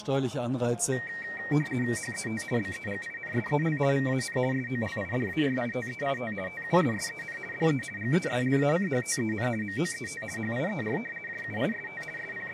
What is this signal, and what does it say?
RTTY (50 baud, 450 Hz shift), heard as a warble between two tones, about 2100 Hz centre. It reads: HET BEGINSEL VAN SOLIDARITEIT TUSSEN DE GESLACHTEN MOET HIER JUIST …